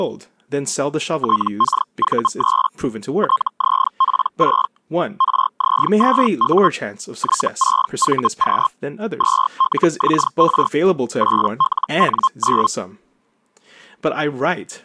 Hellschreiber (Feld-Hell, 122.5 baud), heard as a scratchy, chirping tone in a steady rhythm, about 1060 Hz, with speech in English. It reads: TKV3 TZP6 RZ2U Y6VQ 2LXR 8LN9